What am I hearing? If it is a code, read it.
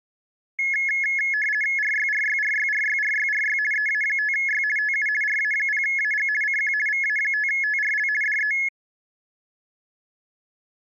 RTTY (50 baud, 450 Hz shift), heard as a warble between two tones, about 1950 Hz centre. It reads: RYRYRYRYRYRY EA5Y TU RA0AG CQ VA5TRL DE